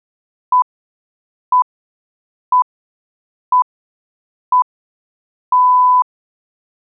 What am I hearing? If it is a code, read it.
Radio time signal (six pips, as the Greenwich Time Signal), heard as pips.